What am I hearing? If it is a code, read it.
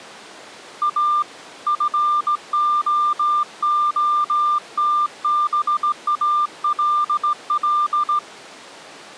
Morse code, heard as a keyed tone, hand-sent with a straight key, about 16 wpm, 1190 Hz. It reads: A FOOTBALL